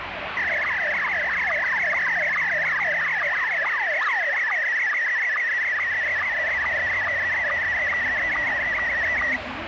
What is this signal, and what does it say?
SSTV (slow-scan television), Scottie S1, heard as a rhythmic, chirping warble, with radio static and street noise.